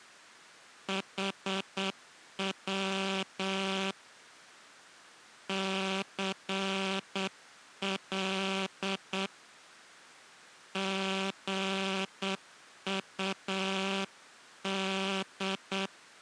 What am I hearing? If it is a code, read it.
Morse code, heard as a buzzer, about 8 wpm. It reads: HW CL GUD